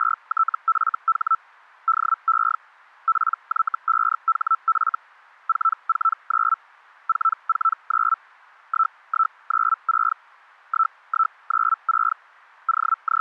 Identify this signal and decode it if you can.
Hellschreiber (Feld-Hell, 122.5 baud), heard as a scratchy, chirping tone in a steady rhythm, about 1320 Hz. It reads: … DE PY5HF 449 449 1196 1196 …